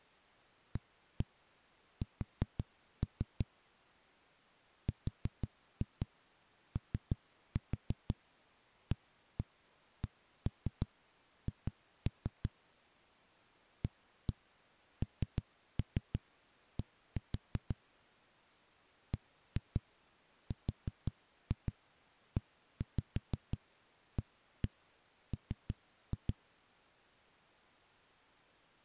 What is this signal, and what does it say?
Tap code, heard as knocks on a wall, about 6 knocks a second. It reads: AS ROACH AND BREAM